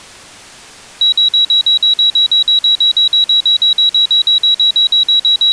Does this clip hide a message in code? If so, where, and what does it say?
No, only evenly repeated beeps.